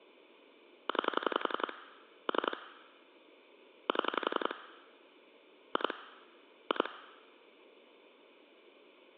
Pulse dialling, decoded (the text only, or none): 9 3 7 2 2